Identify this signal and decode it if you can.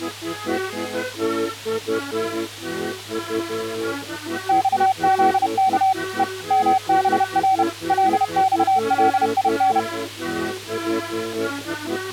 Morse code, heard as a keyed tone, machine-sent, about 31 wpm, 760 Hz. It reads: XZK E MBR LXLIN